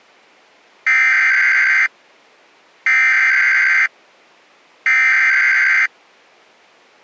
Emergency Alert System (SAME) tones (header bursts), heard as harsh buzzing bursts, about 520.83 baud.